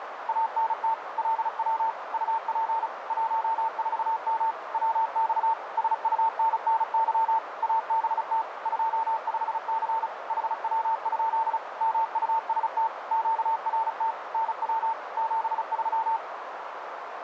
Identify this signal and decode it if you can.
Morse code, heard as a keyed tone, machine-sent, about 35 wpm, 900 Hz, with radio static and a narrow filter. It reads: ANT LW UP 14M WX SUNNY ABT 25C HW? MUST QRT NW 73